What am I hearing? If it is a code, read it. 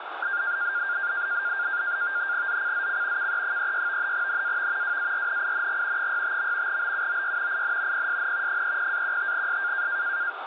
NAVTEX (SITOR-B), 100 baud, 170 Hz shift, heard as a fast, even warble, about 1500 Hz centre, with radio static. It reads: ZCZC KE36 NAV WARNING 65. BUOY IN PSN 30-15S